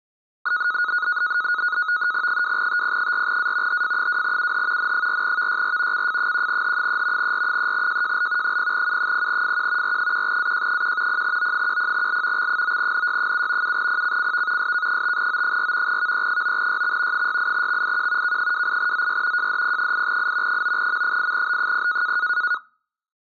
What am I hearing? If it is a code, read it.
NAVTEX (SITOR-B), 100 baud, 170 Hz shift, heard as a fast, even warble, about 1360 Hz centre. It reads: 2TP4A HF2UH N4VYR CF1H3 R3JJL 0U0FQ R1AJ1 0O10L X9NY7 7PCCV SK5O4 VE9YX 68XIQ K28ZY JDP8I 9M8B0